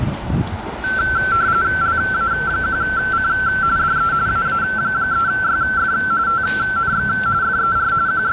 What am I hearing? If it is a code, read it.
RTTY (45.45 baud, 170 Hz shift), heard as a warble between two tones, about 1440 Hz centre, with radio static and the noise of a residential street. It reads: LA1C DE AA3YF TNX FER …